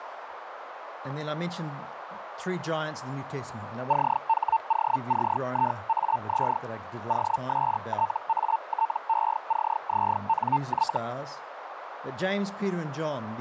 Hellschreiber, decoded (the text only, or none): CHOCIAZ OSTATECZNY